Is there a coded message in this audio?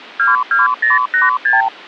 Yes: multi-frequency trunk signalling (R2, with the far end's replies) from 0.2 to 1.7 s, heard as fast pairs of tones, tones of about 160 ms. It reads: 22086